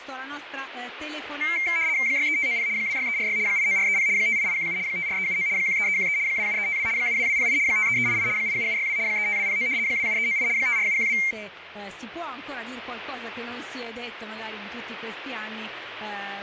RTTY (75 baud, 170 Hz shift), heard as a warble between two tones, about 2200 Hz centre, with radio static. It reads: 63590 26346 89430 58817 54379 13313 27352 72208 53388 87762 35209 27398 54712